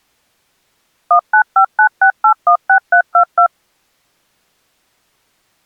DTMF, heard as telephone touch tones, dialled by machine, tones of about 90 ms. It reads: 19596816322